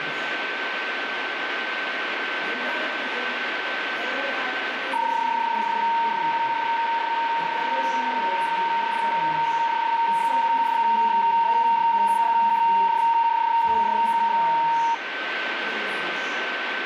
PSK31 (31.25 baud), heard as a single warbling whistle, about 920 Hz, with radio static and a steady whistle near 1540 Hz.